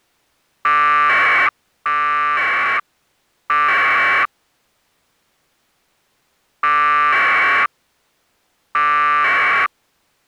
Packet radio (AX.25, as in APRS), 1200 baud, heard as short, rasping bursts.